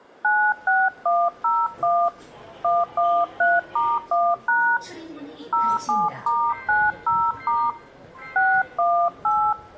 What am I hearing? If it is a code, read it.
DTMF, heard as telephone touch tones, dialled by hand, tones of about 250 ms, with the noise inside a subway train. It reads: 96101 113*1# 07*90* 618